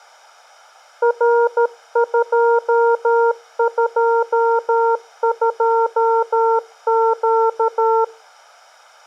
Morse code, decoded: R222Q

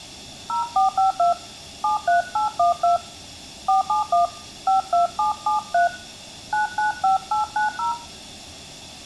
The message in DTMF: 0452 73812 471 52773 995890

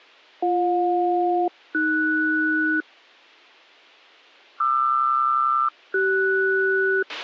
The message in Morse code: none

